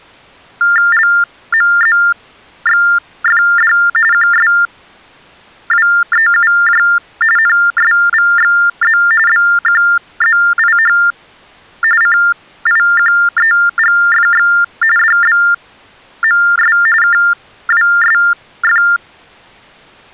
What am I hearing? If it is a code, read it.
TTY/TDD text telephone tones (45.45 baud Baudot), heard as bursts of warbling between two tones, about 400 Hz shift, 1600 Hz centre. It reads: LMZXFD QSWEUJ NSVXZ BQZIH CIQEGFX DBMS KWSF